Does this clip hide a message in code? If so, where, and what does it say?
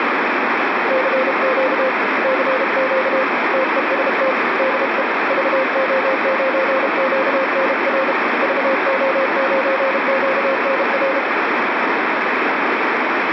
Yes: Morse code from 0.8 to 11.3 s, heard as a keyed tone, hand-sent with a paddle, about 32 wpm, 530 Hz, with heavy radio static. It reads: CQ CQ TEST DE VO9QNR VO9QNR